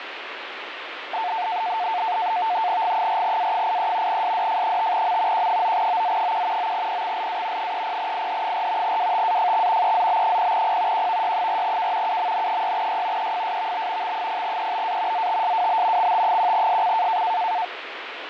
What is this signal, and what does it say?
NAVTEX (SITOR-B), 100 baud, 170 Hz shift, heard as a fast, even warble, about 800 Hz centre, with radio static. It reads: G4A83 SDF5M Q9OZ1 9PXLA 30IH4 WTAFX EZB0P QVY4K UMN6Y EFSVB X0EBA ZTSWB XT1SC